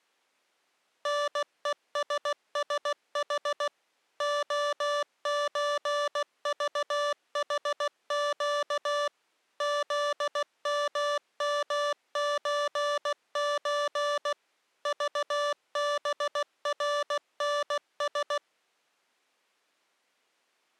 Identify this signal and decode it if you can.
Morse code (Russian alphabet), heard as electronic beeps, machine-sent, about 16 wpm, 580 Hz. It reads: НЕССХ ОЧЖХЩ ЗММЧЧ ЖБРНС